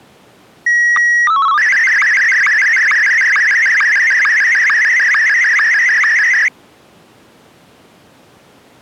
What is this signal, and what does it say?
SSTV (slow-scan television), Martin M1, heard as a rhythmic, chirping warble.